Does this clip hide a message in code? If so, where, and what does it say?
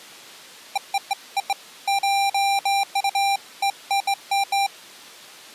No, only beeps of irregular length.